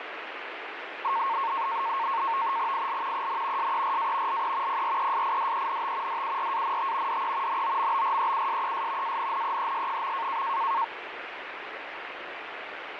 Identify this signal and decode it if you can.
NAVTEX (SITOR-B), 100 baud, 170 Hz shift, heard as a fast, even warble, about 1000 Hz centre, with radio static. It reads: IL EN SERA LE PRESIDENT DURANT DE NOMBREUSES ANNEES.